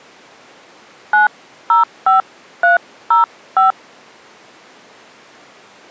DTMF, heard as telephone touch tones, dialled by hand, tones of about 140 ms. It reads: 905305